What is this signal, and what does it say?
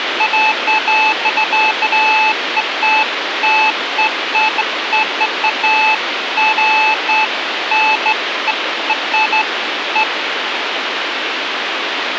Beeps of irregular length, with radio hiss and a squelch burst at the end. There is no code.